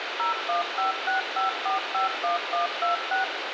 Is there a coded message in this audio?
Yes: DTMF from 0.2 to 3.2 s, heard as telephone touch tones, dialled by machine, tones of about 130 ms, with radio hiss. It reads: 01565451126